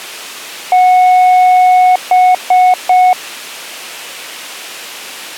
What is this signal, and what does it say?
Beep code, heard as beeps, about 730 Hz. 1 long, 3 short. In Award and IBM BIOS tables: video adapter failure; in AMI BIOS tables: memory failure.